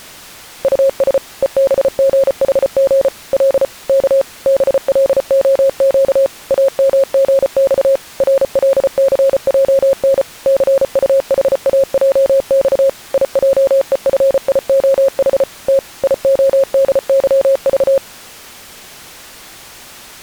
Morse code, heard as a keyed tone, machine-sent, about 34 wpm, 540 Hz. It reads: US EBGHG L K BLOQ AMGX RLCJN CUHAJX IJEFIOH T IODYV